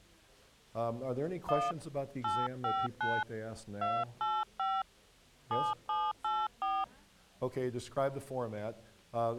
DTMF, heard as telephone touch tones, dialled by hand, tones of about 220 ms. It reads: 1 859 285 7784